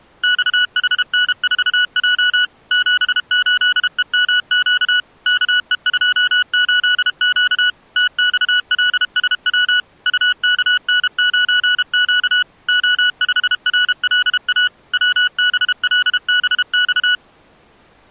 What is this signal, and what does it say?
Morse code, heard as electronic beeps, machine-sent, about 32 wpm, 1470 Hz. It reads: XHN4J 78EMQ KE28Q TXLSW UKN9Q O5RLA WBLBX